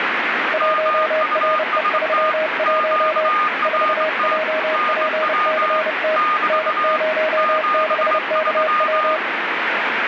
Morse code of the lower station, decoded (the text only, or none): 1RE31 4JPCT N06KW